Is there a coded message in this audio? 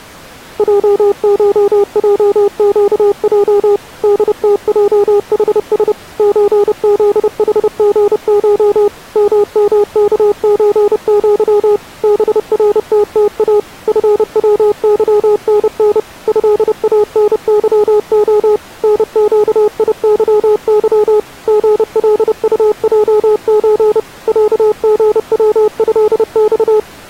Yes: Morse code (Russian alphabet) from 0.5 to 26.9 s, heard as a keyed tone, machine-sent, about 30 wpm, 410 Hz. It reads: ЙШЙЩЙ ДТЙХС ЧЗХГШ ММКЧЪ БРТТА ФВЫНН ЭАНЫО НЩИЫЫ ГЛУЙЧ ЯГВЭЬ